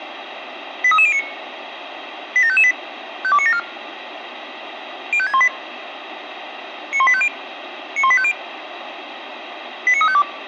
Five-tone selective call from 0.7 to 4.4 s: 83309 87558 52974

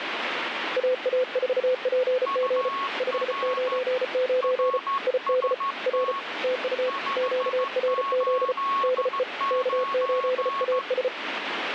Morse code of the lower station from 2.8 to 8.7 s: 599 ID R TU QRZ

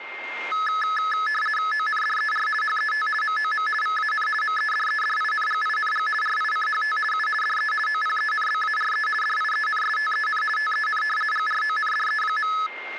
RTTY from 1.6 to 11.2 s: ONDER HET MOM VAN MEDEDINGING RICHT U DE OPENBARE DIENSTEN TEN

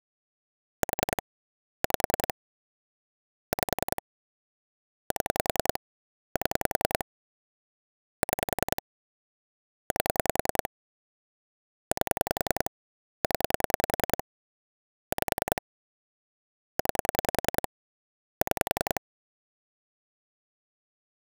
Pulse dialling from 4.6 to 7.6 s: 7 7

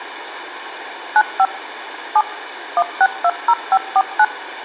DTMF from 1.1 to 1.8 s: 95

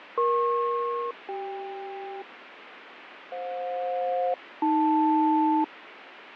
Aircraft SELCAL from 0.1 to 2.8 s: EP-CK

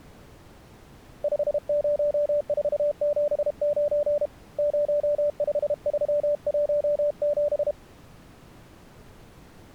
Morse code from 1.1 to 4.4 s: 50479

